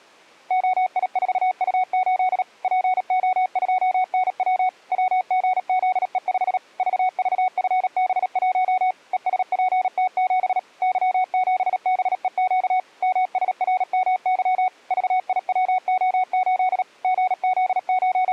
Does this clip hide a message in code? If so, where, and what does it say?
Yes: Morse code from 0.4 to 18.3 s, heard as a keyed tone, machine-sent, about 37 wpm, 740 Hz. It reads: OI4U8 PO2NW WGZE5 VVFB1 ESPT7 Y7BEQ MSRMY VIWO8 …